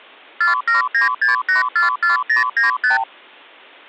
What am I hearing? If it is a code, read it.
Multi-frequency trunk signalling (R2, with the far end's replies), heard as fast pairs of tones, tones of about 140 ms. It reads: 4796844095